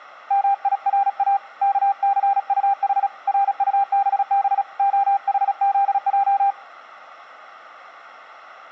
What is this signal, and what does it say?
Morse code (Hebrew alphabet), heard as a keyed tone, hand-sent with a paddle, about 36 wpm, 800 Hz. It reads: מירא כסטח רטבב החזע